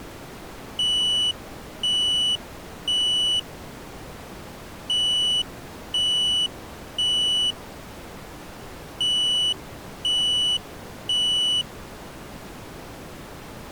Alarm pattern, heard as an alarm's beeps, played three times, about 2950 Hz. Temporal three. Smoke or fire, evacuate.